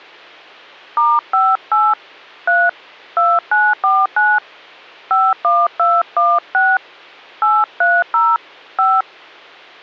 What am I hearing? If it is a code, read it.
DTMF, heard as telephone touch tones, dialled by hand, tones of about 220 ms, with hum. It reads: *58 3 2949 51216 830 5